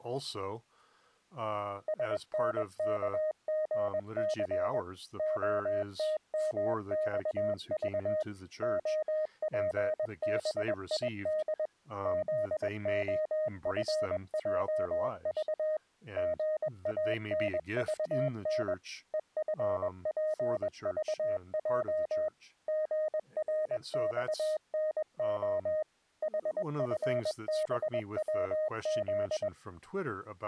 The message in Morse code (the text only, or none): SNKGC OTMXV OPBID ZOFJV GANVN EFPVJ GRXNO HFBWZ